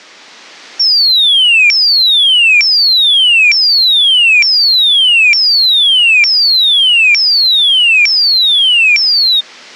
A tone that sweeps in pitch again and again. There is no code.